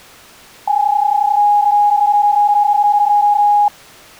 PSK31 (31.25 baud), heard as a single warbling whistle, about 830 Hz.